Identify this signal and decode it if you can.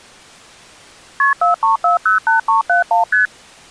Multi-frequency trunk signalling (R1, as on North American trunks), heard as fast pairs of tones, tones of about 130 ms. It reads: KP 43408371 ST